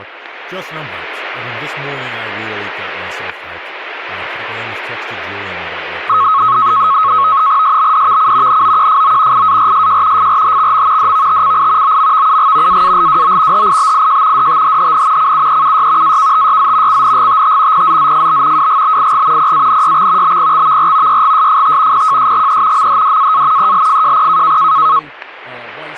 NAVTEX (SITOR-B), 100 baud, 170 Hz shift, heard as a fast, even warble, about 1190 Hz centre, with static crashes and speech in English. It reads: SBDVC NOQFO IARSJ FRHXM DVTCI OMVUG AALWO HIBIJ DTHHN CUEUY AKTYZ CNGTT PZZFB WGBIG PANYX BPXVR YGSFT PJSGE MHDAA ELFJP